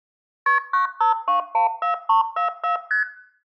Multi-frequency trunk signalling (R1, as on North American trunks), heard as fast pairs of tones, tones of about 120 ms, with room echo. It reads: KP 95214344 ST